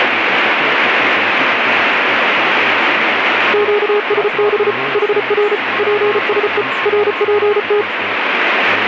Morse code, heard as a keyed tone, machine-sent, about 34 wpm, 420 Hz, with radio static and a weaker station near 1070 Hz. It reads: QSB HR PSE RPT